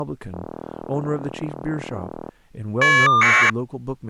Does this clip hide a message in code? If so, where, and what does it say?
Yes: caller ID data burst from 0.3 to 3.5 s, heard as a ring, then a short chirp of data, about 1200 baud, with speech in English.